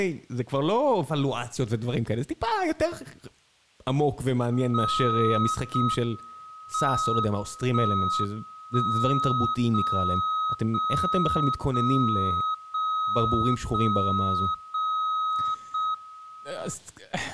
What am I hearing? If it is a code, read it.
Radio time signal (JJY), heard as a tone whose level steps once a second, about 1270 Hz, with speech in Hebrew. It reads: 0 M 1 1 0 0 0 0 0 0 0 M